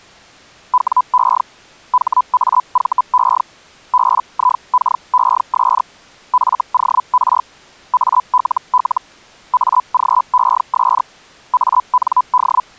Hellschreiber (Feld-Hell, 122.5 baud), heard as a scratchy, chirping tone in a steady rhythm, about 1000 Hz. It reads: WE HAVE BIKES FOR ALL AGES AND